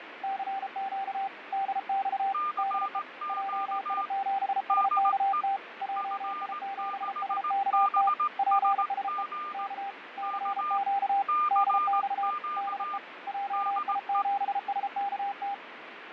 Morse code, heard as two keyed tones, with radio static and fading. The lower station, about 33 wpm, 790 Hz: CQ DX DE JI7SKT JI7SKT PSE K CQ DX DE JI7SKT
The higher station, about 18 wpm, 1200 Hz: CQ DE F6BSG K CQ DE